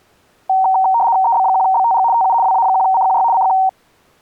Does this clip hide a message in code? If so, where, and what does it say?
Yes: RTTY (75 baud, 170 Hz shift) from 0.5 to 3.7 s, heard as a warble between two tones, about 840 Hz centre. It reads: EB1BTG TU WA1CQY CQ